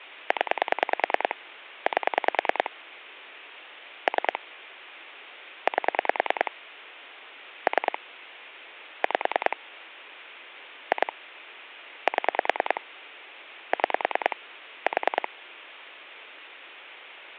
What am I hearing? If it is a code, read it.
Pulse dialling, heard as clicks on a phone line, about 10 pulses a second, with phone line noise. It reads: 0 8 3 8 3 5 2 7 6 4